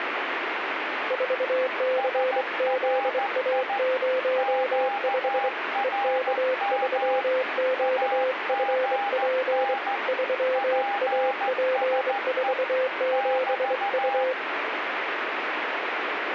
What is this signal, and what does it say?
Morse code, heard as two keyed tones, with radio static. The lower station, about 24 wpm, 520 Hz: 4CZA05 EK3QFP 3AP47U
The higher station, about 14 wpm, 810 Hz: SRI QRM AGN PSE <BT>